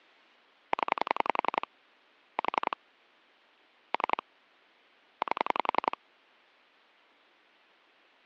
Pulse dialling, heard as clicks on a phone line, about 11 pulses a second. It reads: 0 4 3 8